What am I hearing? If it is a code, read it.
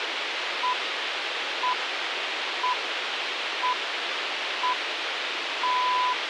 Radio time signal (six pips, as the Greenwich Time Signal), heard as pips, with radio hiss.